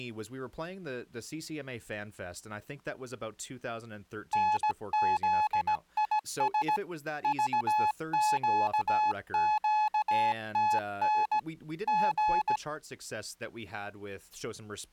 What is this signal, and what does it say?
Morse code, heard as a keyed tone, hand-sent with a paddle, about 17 wpm, 850 Hz, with speech in English. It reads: NZIS VQQTN G